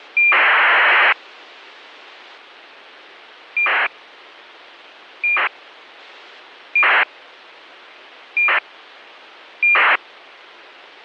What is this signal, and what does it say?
ACARS aircraft data, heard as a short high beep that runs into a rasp, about 2400 baud, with a squelch burst at the end.